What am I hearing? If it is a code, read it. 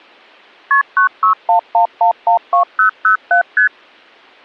Multi-frequency trunk signalling (R1, as on North American trunks), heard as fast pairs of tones, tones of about 110 ms. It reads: KP 9611112007 ST